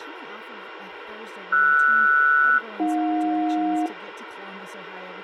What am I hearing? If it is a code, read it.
Aircraft SELCAL, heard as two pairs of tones, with radio hiss. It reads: RS-AJ